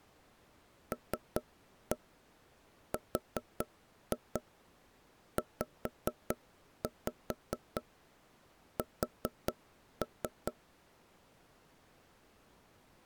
Tap code, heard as knocks on wood, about 4 knocks a second. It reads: LRZS